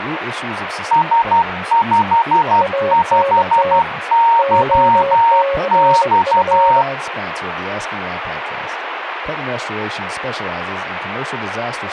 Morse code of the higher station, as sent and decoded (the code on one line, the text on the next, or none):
... ..... ..... -.-- -..-
S55YX